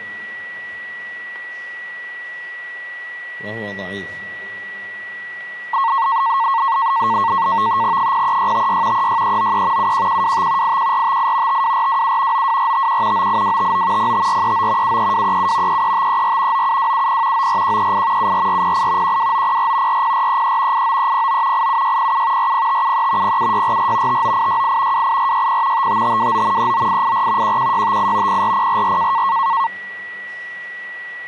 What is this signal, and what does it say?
NAVTEX (SITOR-B), 100 baud, 170 Hz shift, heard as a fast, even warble, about 1000 Hz centre, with a steady whistle near 1940 Hz. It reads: 03656 36393 71125 81458 52427 92451 98259 05439 73237 33534 97270 94138 74408 12904 40433 89309 87607 40573 07644 59868 28460 55529 39884 11658 04044